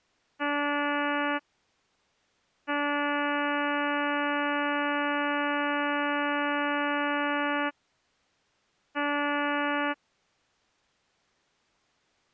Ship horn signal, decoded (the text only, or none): 1 short, 1 long, 1 short